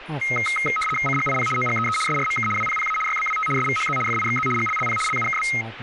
RTTY (75 baud, 850 Hz shift), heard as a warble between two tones, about 1700 Hz centre, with radio static and speech in English. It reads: CGIP OGEE SRMK WPPA YBWT SVHZ FIXZ GLLP LUKB